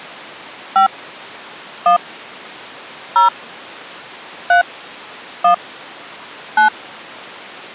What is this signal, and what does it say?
DTMF, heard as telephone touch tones, dialled by hand, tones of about 120 ms. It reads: 5 1 0 3 1 9